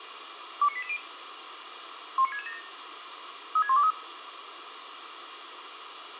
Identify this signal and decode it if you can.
Five-tone selective call (ZVEI), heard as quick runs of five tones, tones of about 70 ms, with radio hiss and room echo. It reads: 29880 19667 36123